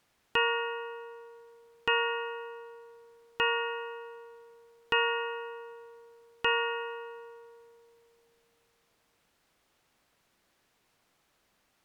Clock strike, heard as a bell. 5. Five o'clock.